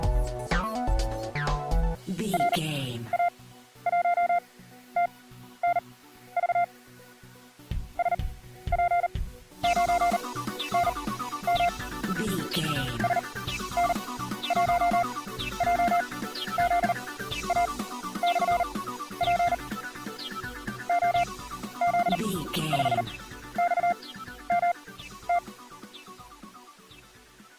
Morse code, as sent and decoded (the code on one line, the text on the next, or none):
.-. .- .---- - -. ...- / ... .--. ----. -. -- / ... -. .---- .--- --.. .- -..-. .--. / --- --.. ..... -..- -- -
RA1TNV SP9NM SN1JZA/P OZ5XMT